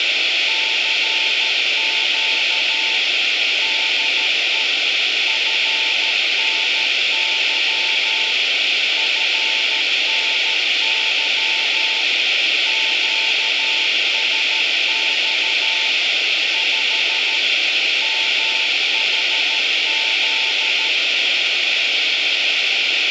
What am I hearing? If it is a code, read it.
Morse code, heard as a keyed tone, machine-sent, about 13 wpm, 890 Hz, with radio hiss. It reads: CQ DE FNY FNY QSX 5 MHZ